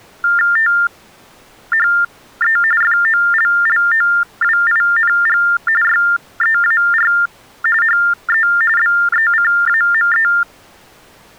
TTY/TDD text telephone tones (45.45 baud Baudot), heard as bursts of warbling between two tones, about 400 Hz shift, 1600 Hz centre. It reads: THE FOLLOWING YEAR HE BECAME